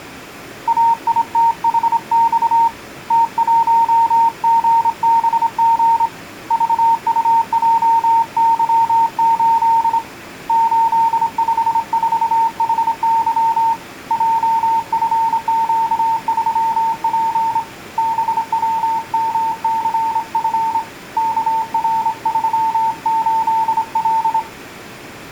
Morse code, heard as a keyed tone, hand-sent with a straight key, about 26 wpm, 910 Hz. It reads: AITHX T1GBG VUJY8 854HY JFQ3P BWMCF KR38L